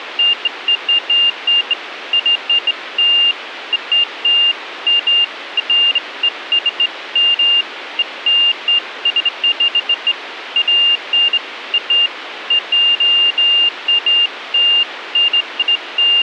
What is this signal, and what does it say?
Beeps of irregular length, with radio hiss. There is no code.